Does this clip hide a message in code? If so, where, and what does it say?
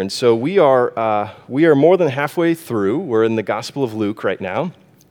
No.